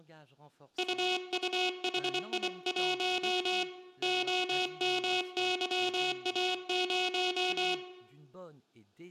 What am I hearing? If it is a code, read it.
Morse code, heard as a buzzer, hand-sent with a bug key, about 24 wpm, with room echo and speech in French. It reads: UUHI1 OMYA0